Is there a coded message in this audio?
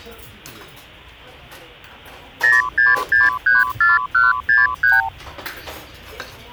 Yes: multi-frequency trunk signalling (R2, with the far end's replies) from 2.4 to 5.1 s, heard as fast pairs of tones, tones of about 170 ms, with the noise of a restaurant. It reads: 06634163